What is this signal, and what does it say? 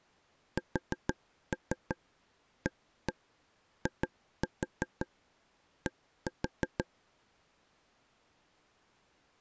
Tap code, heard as taps on a table, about 6 knocks a second. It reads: SAID